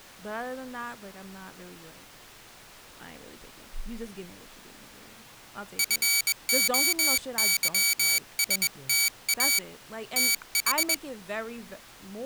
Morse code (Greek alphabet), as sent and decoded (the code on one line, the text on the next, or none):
..-. --- -.-- ... - .- / - ....
ΦΟΥΣΤΑ ΤΗ